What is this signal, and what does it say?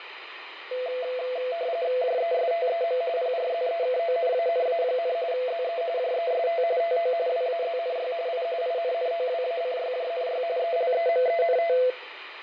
RTTY (45.45 baud, 170 Hz shift), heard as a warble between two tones, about 590 Hz centre, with radio static and fading. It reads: JESTEM PRZEKONANA, ZE JEST TO WAZNY I INNOWACYJNY ELEMENT